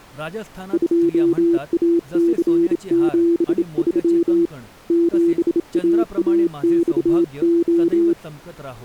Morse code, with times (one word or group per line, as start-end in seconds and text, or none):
0.7-4.5 2AC73
4.9-8.1 7AAXO